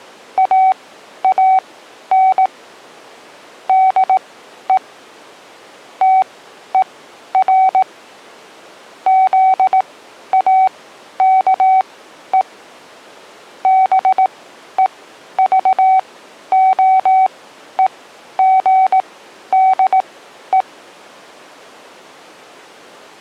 Morse code, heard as a keyed tone, machine-sent, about 18 wpm, spaced as for 11 wpm, 760 Hz. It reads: AAN DE TER ZAKE BEVOEGDE